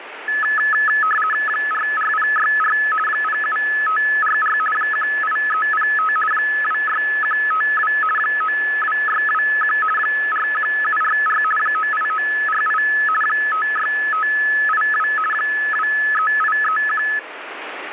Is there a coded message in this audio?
Yes: RTTY (50 baud, 450 Hz shift) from 0.3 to 17.2 s, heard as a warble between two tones, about 1500 Hz centre, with radio static. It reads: 44064 07544 18305 26152 92621 41744 98948 56582 23831